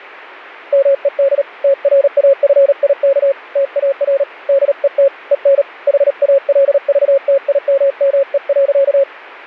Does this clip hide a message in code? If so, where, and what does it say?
Yes: Morse code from 0.7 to 9.1 s, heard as a keyed tone, hand-sent with a paddle, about 37 wpm, 550 Hz. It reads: MED TRAFIK TAR DET EN HALVTIMME.